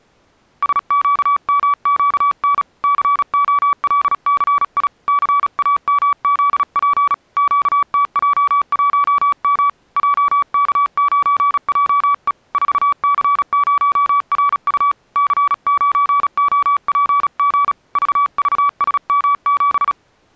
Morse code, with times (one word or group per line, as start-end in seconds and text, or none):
0.6-2.6 SQMQN
2.8-4.9 COLCI
5.1-7.1 CAMZP
7.4-9.7 QTJ1M
10.0-12.3 JK9JE
12.5-14.9 4C0RU
15.2-17.7 C9OPG
18.0-19.9 VVSM7